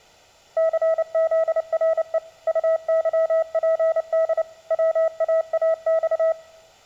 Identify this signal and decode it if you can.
Morse code, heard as a keyed tone, machine-sent, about 29 wpm, 650 Hz. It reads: CZRE UYPD WAAX